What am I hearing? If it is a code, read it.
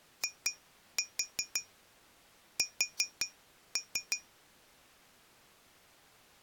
Tap code, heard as taps on glass, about 5 knocks a second. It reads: IS